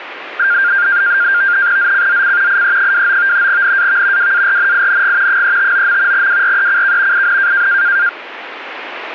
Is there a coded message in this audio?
Yes: NAVTEX (SITOR-B), 100 baud, 170 Hz shift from 0.4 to 8.1 s, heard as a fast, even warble, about 1500 Hz centre. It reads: ZCZC IE29 NAV WARNING 359. WRECK IN